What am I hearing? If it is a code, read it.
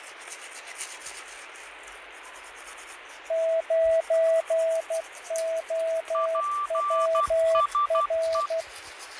Morse code, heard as two keyed tones, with radio static, fading and the noise of a restroom. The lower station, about 12 wpm, 650 Hz: 9OWR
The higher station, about 12 wpm, 1170 Hz: PSE